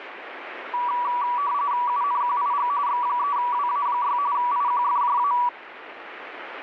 RTTY (45.45 baud, 170 Hz shift), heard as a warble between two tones, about 1060 Hz centre, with radio static. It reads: UNQIG X3WA6 IQFJA